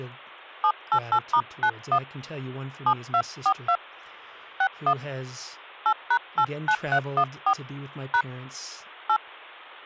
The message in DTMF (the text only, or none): 788*91 7242 61 8#89314 # 8